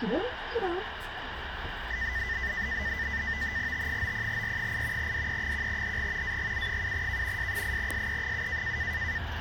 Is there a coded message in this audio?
Yes: NAVTEX (SITOR-B), 100 baud, 170 Hz shift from 1.9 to 9.2 s, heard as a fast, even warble, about 1900 Hz centre, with radio static and the noise inside a bus. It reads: T90R8 DE1HG AGU7K S8SE7